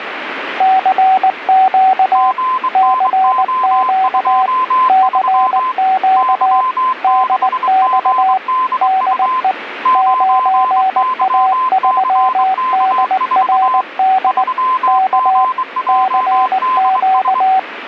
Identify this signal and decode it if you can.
Morse code, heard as two keyed tones, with radio static. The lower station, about 19 wpm, 760 Hz: CQ CQ CQ DX DE 9A3DRD K CQ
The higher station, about 23 wpm, 1030 Hz: GNO23 Y6GDU 9YCK4 3GJDS